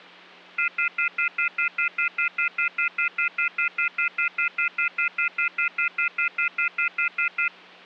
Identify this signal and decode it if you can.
Telephone call progress tone (North American plan), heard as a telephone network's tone, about 1400, 2050, 2450, 2600 Hz, 0.1 s on and 0.1 s off, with hum. Off-hook warning tone.